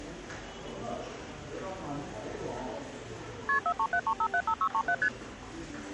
Multi-frequency trunk signalling (R1, as on North American trunks), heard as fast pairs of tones, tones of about 70 ms, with hum and the noise of a subway station. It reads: KP 4373575637 ST